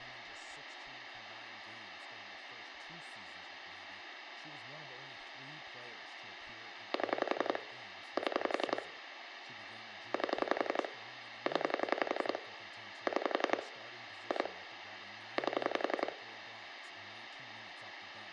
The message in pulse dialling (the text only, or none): 7 7 8 0 6 2 8